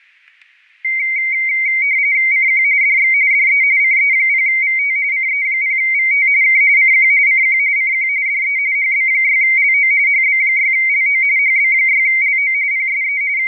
RTTY (45.45 baud, 170 Hz shift), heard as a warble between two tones, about 2150 Hz centre, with static crashes. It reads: CQ DX DE CE0VT CE0VT K CQ CQ CQ DE HB6LO HB6LO HB6LO PSE …